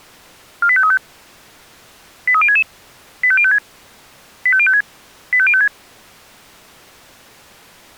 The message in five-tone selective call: 48535 83066 85056 85056 85056

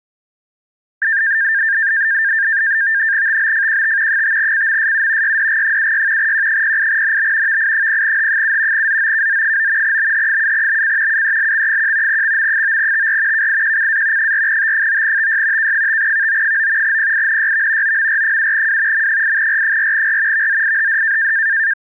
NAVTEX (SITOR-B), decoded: TBFQT 5CMSU YDG76 Q08NB VI0H7 ZOKZ9 BH7BC UELX1 XM9TR KIQCA 4T9TY K5VO9 PINYV OMR7W M8R4R VZIHD

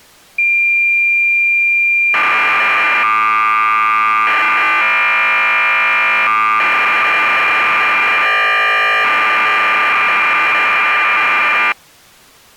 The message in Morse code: none

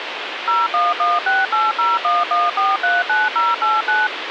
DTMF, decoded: 01168011439089

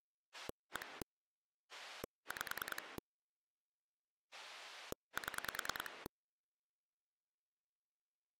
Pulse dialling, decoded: 1 5 7

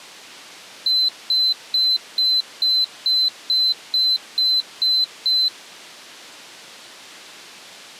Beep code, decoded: 11 short

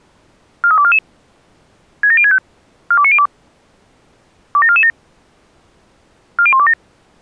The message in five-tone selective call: 43244 67065 42902 27447 40127

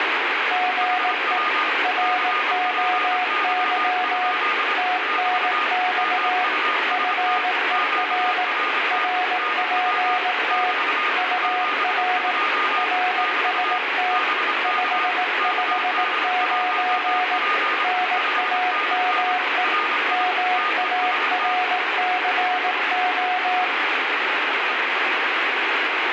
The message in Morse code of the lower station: GE ROY TNX FER RPT UR RST 559 NAME MARCO

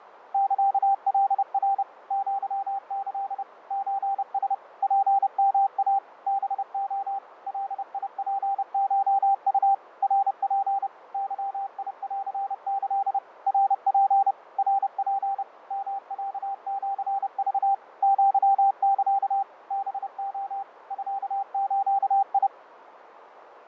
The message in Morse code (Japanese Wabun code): サカナ アキ ソラ ツヨイ ハレ ガツコウ ナツ ゲンキ ナツ ナツ ヨロシク アサ ハレ ミズ

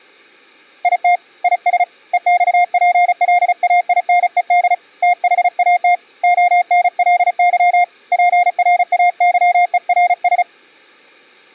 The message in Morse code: IT IS EXPLAINED THAT ONLY PRAYERS

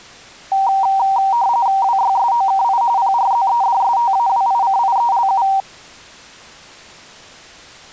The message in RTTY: WYSOKI PRZEDSTAWICIELU

